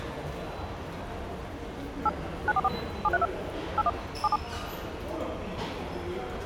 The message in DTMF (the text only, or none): 8 944 732 81 77